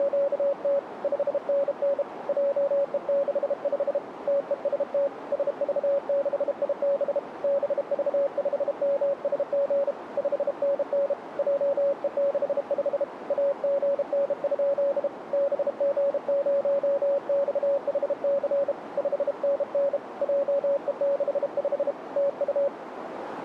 Morse code, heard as a keyed tone, hand-sent with a bug key, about 32 wpm, 560 Hz, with radio static and a narrow filter. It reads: … 5NN JE65 TEST SV6IB BV5MSG 5NN JE65 AGN? BG0XHC 5NN JE65 TU